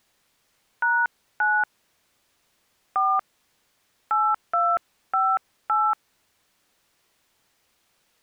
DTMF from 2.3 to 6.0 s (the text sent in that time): 4 8258